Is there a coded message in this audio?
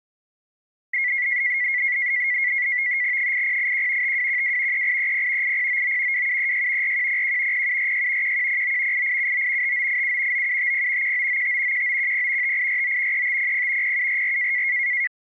Yes: NAVTEX (SITOR-B), 100 baud, 170 Hz shift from 0.9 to 15.1 s, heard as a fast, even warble, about 2050 Hz centre. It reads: 8081 5212 3830 8099 2736 4101 0746 1109 8879 5987 9750 1995 1910 5849 3500 0744